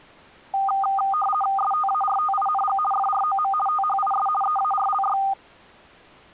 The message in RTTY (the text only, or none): STARTING FROM THIS EARLY